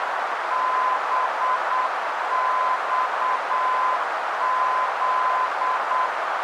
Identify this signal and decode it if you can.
Morse code, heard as a keyed tone, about 8 wpm, 1020 Hz, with heavy radio static and a narrow filter. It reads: BXZ